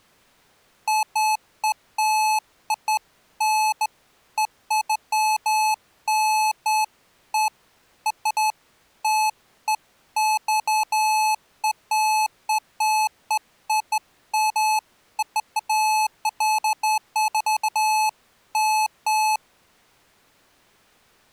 Beeps of irregular length. There is no code.